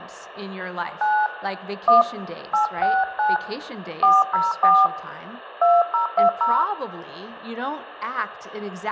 DTMF, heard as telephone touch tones, dialled by hand, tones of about 200 ms, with room echo. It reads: 9 1 869 404 2020